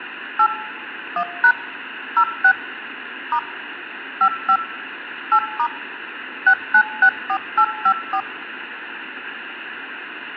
DTMF, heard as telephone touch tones, dialled by machine, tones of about 70 ms, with phone line noise. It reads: 8 1# 06 * 55 8* 6964854